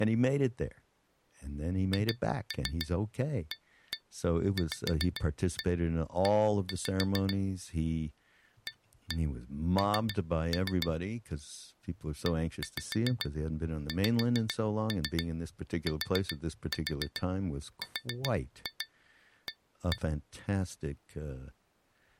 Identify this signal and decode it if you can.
Tap code, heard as taps on glass, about 7 knocks a second, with speech in English. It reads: HAVE AN EXTRA